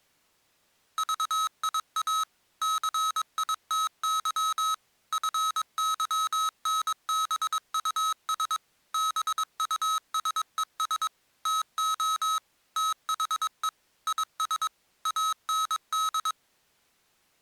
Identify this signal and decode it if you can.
Morse code, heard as electronic beeps, machine-sent, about 22 wpm, 1280 Hz. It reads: VIA CITY FYNBUS BUSES TO THE IS AND